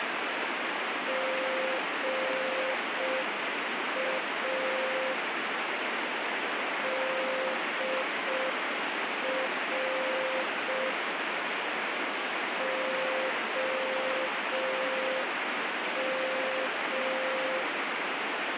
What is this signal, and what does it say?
Morse code, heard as a keyed tone, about 5 wpm, 520 Hz, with heavy radio static. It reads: GA DR OM